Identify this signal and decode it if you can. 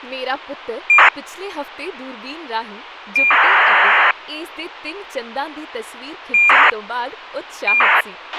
ACARS aircraft data, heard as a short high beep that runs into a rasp, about 2400 baud, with a squelch burst at the end and speech in Punjabi.